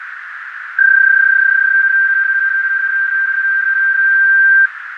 PSK31 (31.25 baud), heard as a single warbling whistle, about 1600 Hz, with radio static, fading and a narrow filter.